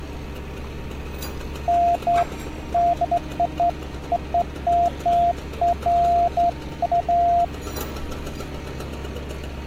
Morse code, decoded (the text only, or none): none